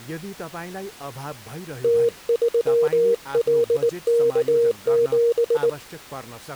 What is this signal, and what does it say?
Morse code, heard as a keyed tone, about 19 wpm, 470 Hz, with speech in Nepali. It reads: T3LK7